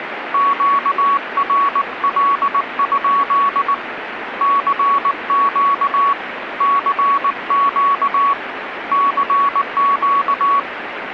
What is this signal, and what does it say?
Morse code, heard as a keyed tone, hand-sent with a paddle, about 19 wpm, 1120 Hz, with radio static. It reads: QRL? CQ CQ CQ